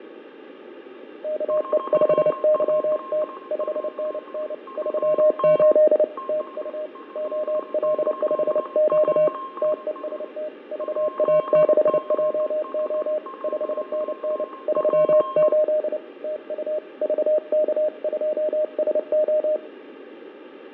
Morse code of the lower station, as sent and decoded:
-.- . ..... -.-- - / ..... -. -. / ...-- ---.. / - ..- / --- .-.. ..... --.- / - . ... - / ...- .- -.... .--- --- / ..... -. -. / ...-- ---.. / - ..- / ...- -.- ..--- ... ---
KE5YT 5NN 38 TU OL5Q TEST VA6JO 5NN 38 TU VK2SO

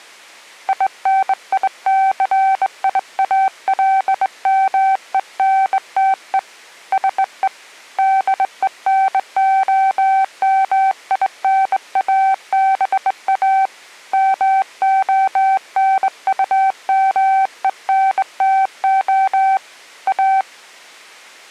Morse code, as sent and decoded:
.. -. .. -.-. .. .- .-.. -- . -. - . / ... . / -.. . -. --- -- .. -. .- -... .- / -- --- -. ..- -- . -. - --- / .-
INICIALMENTE SE DENOMINABA MONUMENTO A

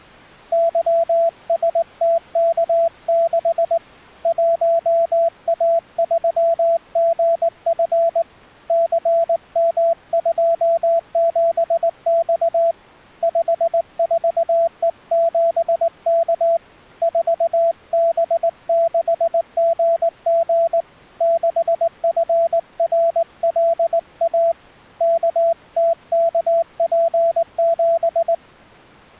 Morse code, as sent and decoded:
-.-- ... - -.- -.... / .---- .- ...-- --. ..-. / -.-. -- ..--- --... -..- / ..... ....- . --... -.- / ....- -... -.... --. --. / -.... ..-. .-. .-.. .- / -.- - -.- .--. --...
YSTK6 1A3GF CM27X 54E7K 4B6GG 6FRLA KTKP7

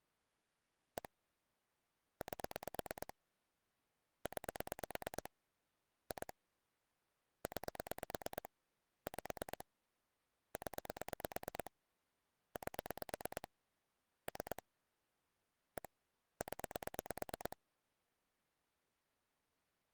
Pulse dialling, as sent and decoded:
1 / 8 / 9 / 2 / 9 / 5 / 10 / 8 / 3 / 1 / 10
1 8 9 2 9 5 0 8 3 1 0

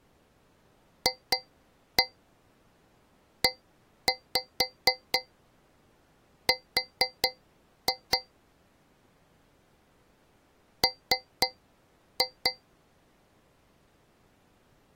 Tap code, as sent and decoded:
2-1 1-5 4-2 / 3-2
FER M

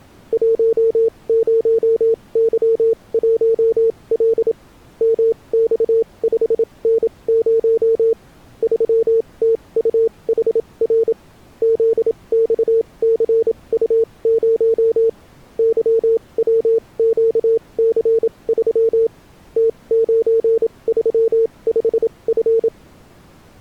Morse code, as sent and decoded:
.---- ----- -.-- .---- .-.. / -- -..- ..... -. ----- / ...-- - ..- .... .-. / --.. -..- -.-. ..- ----- / -.-- .-- --.- -.-. ...-- / - ----. ...-- ..... ..-.
10Y1L MX5N0 3TUHR ZXCU0 YWQC3 T935F

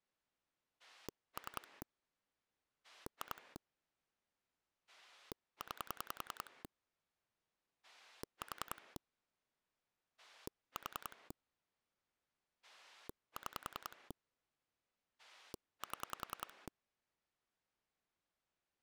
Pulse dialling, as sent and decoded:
3 / 2 / 9 / 4 / 4 / 6 / 7
3 2 9 4 4 6 7

